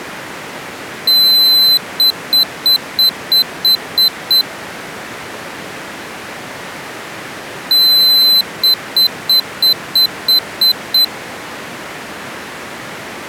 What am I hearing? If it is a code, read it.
Beep code, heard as a piezo beeper, played twice, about 4050 Hz. 1 long, 8 short. In AMI BIOS tables: display or retrace test failure.